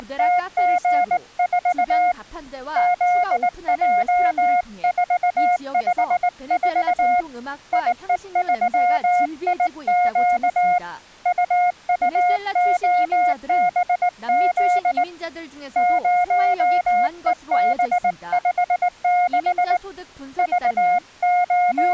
Morse code, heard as a keyed tone, hand-sent with a straight key, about 19 wpm, 720 Hz, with speech in Korean. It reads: … ZJ454 IE3IQ UUOBZ 0EB56 …